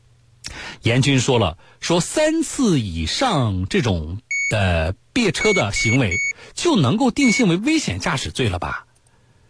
Beep code, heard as a piezo beeper, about 2250 Hz, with speech in Chinese. 1-3-1. In Phoenix BIOS tables: memory refresh failure.